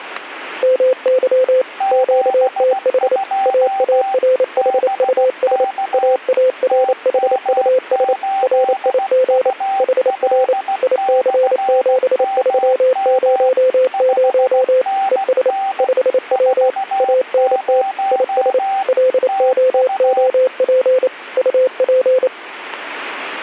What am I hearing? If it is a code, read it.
Morse code, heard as two keyed tones, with static crashes. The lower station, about 28 wpm, 510 Hz: MY QTH AARHUS AARHUS RIG HR IC7300 ES 5W ANT IS LOOP UP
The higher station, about 16 wpm, 780 Hz: 72 BK TM8UL/MM 5NN 40 TU